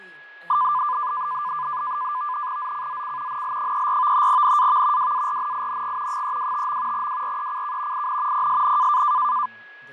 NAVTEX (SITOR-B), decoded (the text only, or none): ZCZC NL34 NAV WARNING 325. WRECK IN PSN